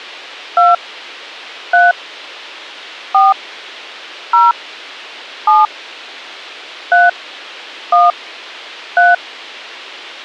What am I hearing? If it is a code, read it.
DTMF, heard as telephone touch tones, dialled by hand, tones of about 180 ms. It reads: 2 3 4 0 7 3 1 3